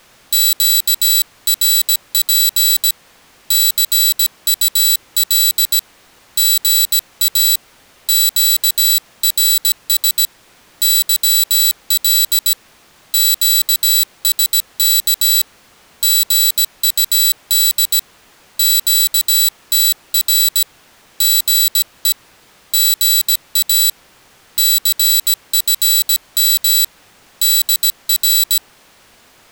Morse code, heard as a high beeper, hand-sent with a paddle, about 17 wpm, 3950 Hz. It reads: QRP CUL GA QRS YL QSK GUD QTR GE GA CFM DR